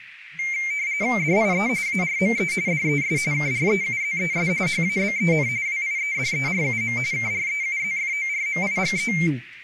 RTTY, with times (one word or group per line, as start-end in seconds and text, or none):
1.2-1.7 DIE
1.9-2.5 ARME
2.7-3.2 DES
3.3-4.5 KREUZES
4.7-5.5 HABEN
5.7-7.0 WIEDERUM
7.1-9.1 KREUZFORMIGE